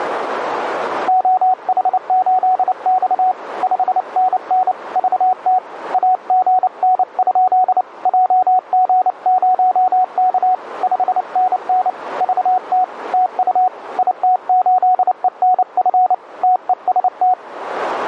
Morse code, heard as a keyed tone, hand-sent with a paddle, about 29 wpm, 740 Hz, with radio static and a narrow filter. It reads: OH8X 5NN VT AGN? JG0K 5NN VT TU IT8ENF TEST